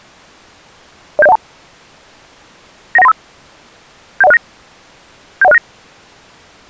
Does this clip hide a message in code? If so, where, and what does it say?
Yes: five-tone selective call (EIA) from 1.2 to 5.6 s, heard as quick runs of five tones, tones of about 30 ms. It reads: 07012 91935 71069 71069